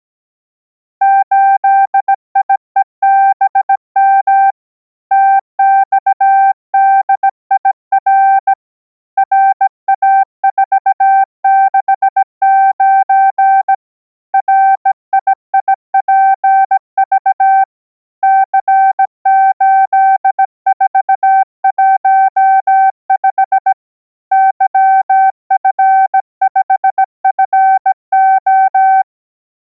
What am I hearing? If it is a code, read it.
Morse code, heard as a keyed tone, hand-sent with a bug key, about 17 wpm, 780 Hz. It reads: 8IEBM TXDIR RA469 RIIPV C8415 YF5FO